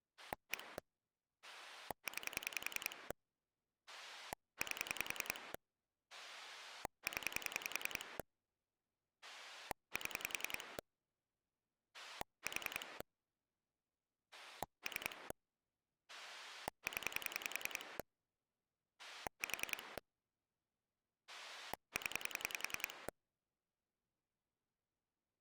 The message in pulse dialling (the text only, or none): 1 9 8 0 7 4 3 0 4 0